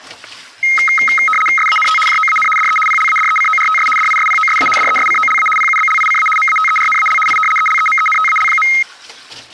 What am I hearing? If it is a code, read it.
RTTY (75 baud, 850 Hz shift), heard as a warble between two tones, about 1700 Hz centre, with static crashes and kitchen noise. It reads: SANT JOAN DE PLADECORTS DISPOSA DESCOLA PUBLICA MATERNAL I ELEMENTAL.